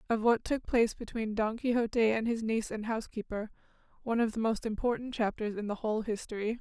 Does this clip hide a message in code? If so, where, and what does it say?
No, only speech in English.